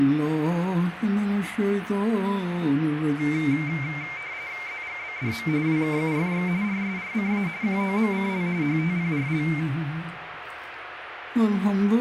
RTTY (45.45 baud, 170 Hz shift), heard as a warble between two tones, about 2200 Hz centre, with radio static. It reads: ZGBDM WKUFX RSRCA QOMCL HTPRL